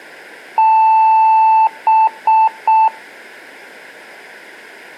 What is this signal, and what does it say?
Beep code, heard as beeps, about 880 Hz. 1 long, 3 short. In Award and IBM BIOS tables: video adapter failure; in AMI BIOS tables: memory failure.